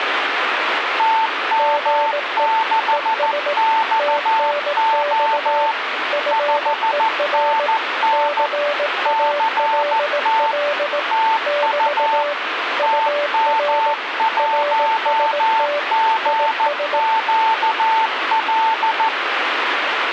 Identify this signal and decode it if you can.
Morse code, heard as two keyed tones, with radio static. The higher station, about 14 wpm, 890 Hz: TM6XO 5NN CT TU TM1GQL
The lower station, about 18 wpm, 580 Hz: GE ES TNX FER CALL <BT> UR RST IS